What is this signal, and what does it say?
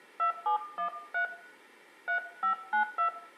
DTMF, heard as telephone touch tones, dialled by hand, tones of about 110 ms, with room echo. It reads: 2713 3592